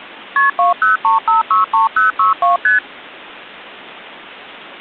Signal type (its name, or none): multi-frequency trunk signalling